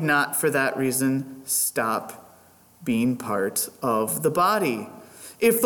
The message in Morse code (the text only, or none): none